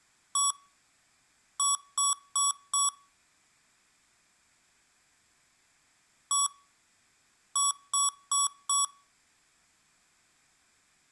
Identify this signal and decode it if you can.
Beep code, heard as beeps from a small speaker, played twice, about 1130 Hz, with room echo. 1-4.